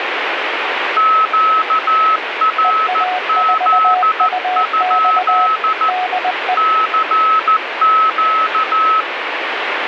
Morse code, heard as two keyed tones, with radio static. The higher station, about 14 wpm, 1290 Hz: QRZ? CQ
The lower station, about 20 wpm, 730 Hz: EA4UX DE